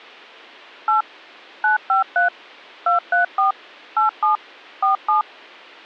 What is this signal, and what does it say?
DTMF, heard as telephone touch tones, dialled by machine, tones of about 130 ms. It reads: 8 953 234 87 47